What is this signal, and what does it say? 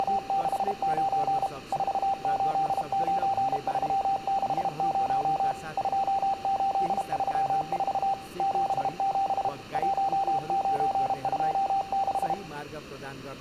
Morse code, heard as a keyed tone, machine-sent, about 32 wpm, 780 Hz, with room echo and speech in Nepali. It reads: … 489360 2834 77 1926